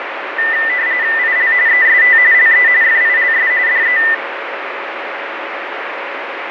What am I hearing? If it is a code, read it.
RTTY (45.45 baud, 170 Hz shift), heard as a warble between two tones, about 1900 Hz centre, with radio static. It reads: IL EST LE FILS DE